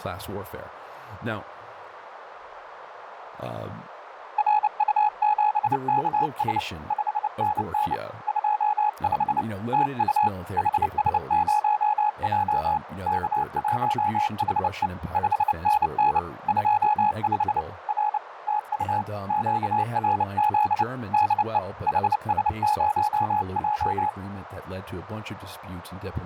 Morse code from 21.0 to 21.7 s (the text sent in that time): DE